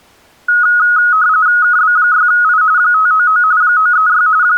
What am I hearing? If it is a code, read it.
RTTY (45.45 baud, 170 Hz shift), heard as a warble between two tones, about 1360 Hz centre. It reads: KB6I 599 936 …